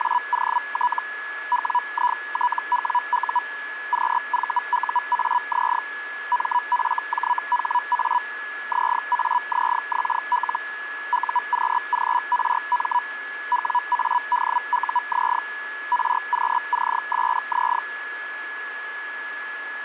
Hellschreiber (Feld-Hell, 122.5 baud), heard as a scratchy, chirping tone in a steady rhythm, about 980 Hz, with radio static and a steady whistle near 1700 Hz. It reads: … WITWU QVUAZ MFJHA ZAZXL UQGRM WADUZ RQCSZ